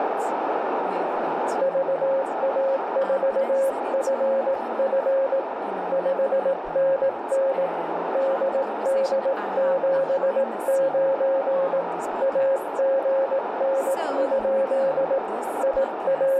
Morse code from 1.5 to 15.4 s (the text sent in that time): VA4FF 5NN DD79 AGN?